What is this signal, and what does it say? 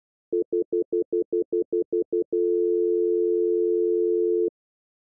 Telephone call progress tone (North American plan), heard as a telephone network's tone, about 350, 440 Hz, 0.1 s on and 0.1 s off. Stutter dial tone.